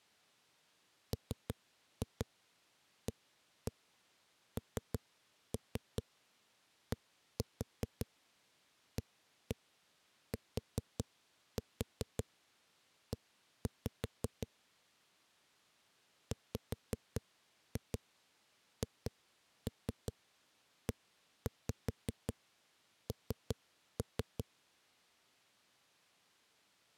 Tap code, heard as knocks on a wall, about 5 knocks a second. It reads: MANDATE WHEN